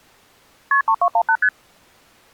Multi-frequency trunk signalling (R1, as on North American trunks), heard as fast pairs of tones, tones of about 70 ms. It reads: KP 3218 ST